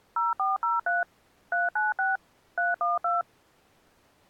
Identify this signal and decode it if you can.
DTMF, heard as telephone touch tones, dialled by machine, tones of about 170 ms. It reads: 0403 396 312